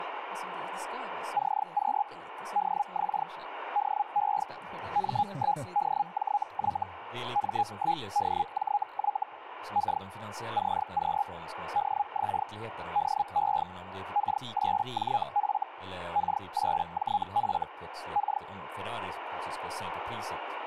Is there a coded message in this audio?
Yes: Hellschreiber (Feld-Hell, 122.5 baud) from 1.3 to 18.4 s, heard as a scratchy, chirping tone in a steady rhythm, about 820 Hz, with radio static and speech in Swedish. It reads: CQ DX DE M1DJY M1DJY K CQ DX DE K8JF K8JF K